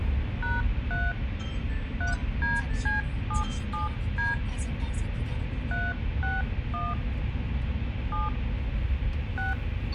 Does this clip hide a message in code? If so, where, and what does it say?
Yes: DTMF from 0.4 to 9.5 s, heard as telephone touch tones, dialled by hand, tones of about 170 ms, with radio hiss and the noise inside a car. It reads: #3 3DC77D 361 7 6